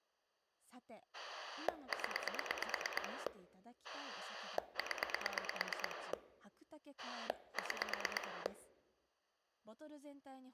Pulse dialling, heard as a rotary dial, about 9 pulses a second, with speech in Japanese. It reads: 0 0 6